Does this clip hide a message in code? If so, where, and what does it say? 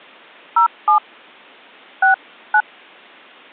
Yes: DTMF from 0.6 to 2.6 s, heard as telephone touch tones, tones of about 110 ms. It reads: 07 69